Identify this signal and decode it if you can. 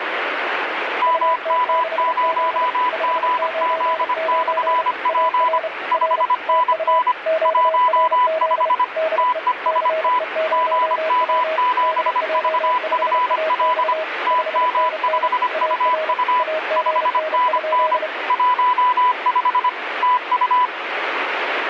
Morse code, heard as two keyed tones, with radio static. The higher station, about 25 wpm, 1000 Hz: MM0GZ/P 5NN 15 TEST GM7VFL TM5UU 5NN 15 TU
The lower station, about 31 wpm, 640 Hz: UT6Z 599 AR R TU QRZ DE CE0W DJ5AX 5NN AR AGN?